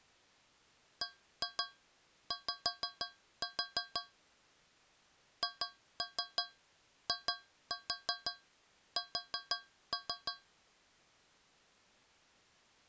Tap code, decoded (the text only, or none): BY HIS